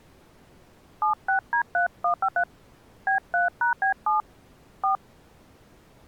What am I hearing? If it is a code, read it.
DTMF, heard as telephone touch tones, dialled by hand, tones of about 110 ms. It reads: 76D3153 B3#B7 4